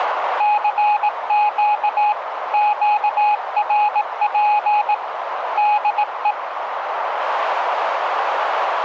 Morse code, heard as a keyed tone, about 18 wpm, 840 Hz, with radio static and a narrow filter. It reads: CQ QRP DE